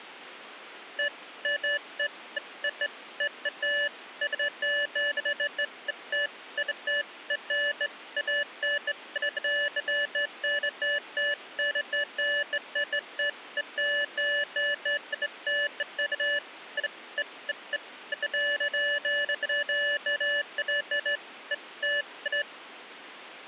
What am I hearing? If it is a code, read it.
Beeps of irregular length. There is no code.